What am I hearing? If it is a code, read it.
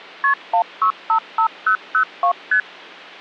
Multi-frequency trunk signalling (R1, as on North American trunks), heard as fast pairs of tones, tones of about 90 ms. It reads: KP 1655002 ST